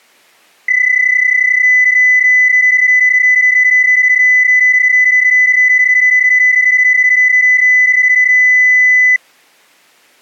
PSK31 (31.25 baud), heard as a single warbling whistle, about 2000 Hz.